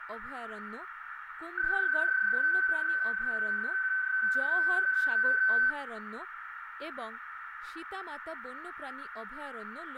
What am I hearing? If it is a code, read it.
PSK31 (31.25 baud), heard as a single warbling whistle, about 1550 Hz, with radio static, a narrow filter, room echo and speech in Bangla.